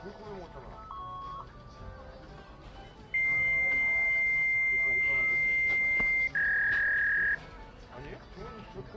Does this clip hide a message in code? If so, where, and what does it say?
Yes: fax machine handshake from 0.9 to 7.3 s, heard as a beep, a long tone and a warble, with the noise of a crowd indoors.